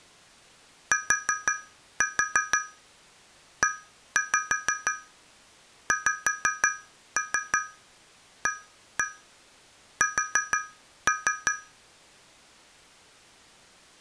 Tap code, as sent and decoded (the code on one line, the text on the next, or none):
4-4 1-5 5-3 1-1 4-3
TEXAS